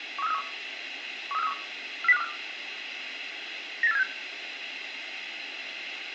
Five-tone selective call (EEA), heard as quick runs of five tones, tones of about 40 ms, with radio hiss and room echo. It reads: 13431 13431 40524 98476